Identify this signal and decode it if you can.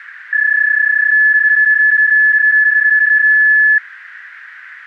PSK31 (31.25 baud), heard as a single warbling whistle, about 1700 Hz, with radio static.